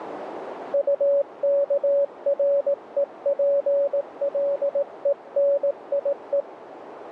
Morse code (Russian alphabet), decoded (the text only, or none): УКРЕПЛЕНИЕ